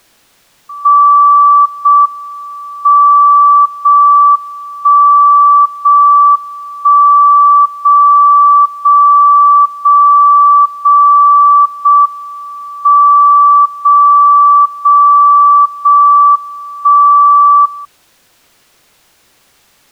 Radio time signal (JJY), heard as a tone whose level steps once a second, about 1160 Hz. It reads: 0 M 0 1 0 1 0 0 0 0 0 M 0 0 0 1 0